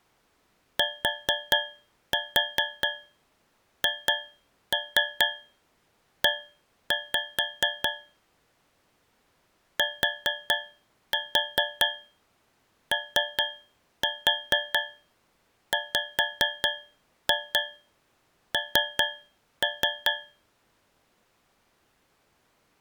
Tap code, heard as taps on a metal pipe, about 4 knocks a second. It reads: THE TOWN